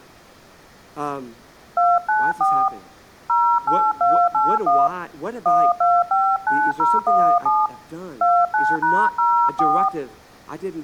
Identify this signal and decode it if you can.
DTMF, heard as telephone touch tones, dialled by hand, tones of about 260 ms, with speech in English. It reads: 294 08281 1259017 29#04